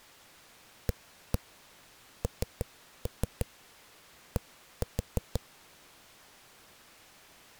Tap code, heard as knocks on a wall, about 6 knocks a second. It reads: AND